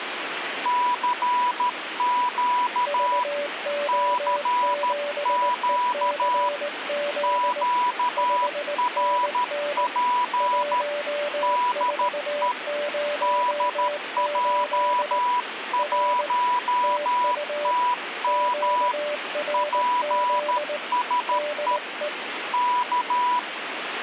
Morse code, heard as two keyed tones, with radio static. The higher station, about 13 wpm, 980 Hz: CQ CQ QRP DE DJ1TM PSE K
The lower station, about 19 wpm, 590 Hz: VO7ECZ 5NN 1408 R TU QRZ DE